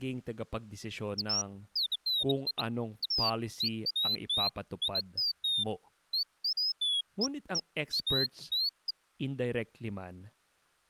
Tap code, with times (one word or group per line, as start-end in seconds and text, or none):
none